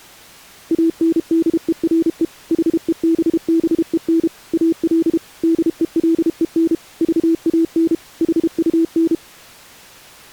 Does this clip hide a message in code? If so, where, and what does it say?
Yes: Morse code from 0.7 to 9.2 s, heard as a keyed tone, machine-sent, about 32 wpm, 330 Hz. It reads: ANDERE HEBBEN AL DELEN VAN HUN